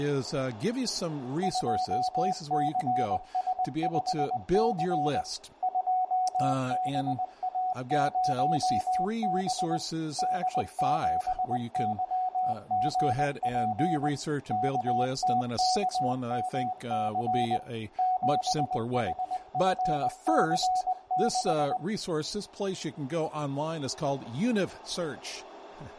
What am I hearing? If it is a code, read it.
Morse code, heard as a keyed tone, machine-sent, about 20 wpm, 740 Hz, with radio static, room echo and speech in English. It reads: 2CS5C 2BA0B D7YGP KTKMC 7HFC6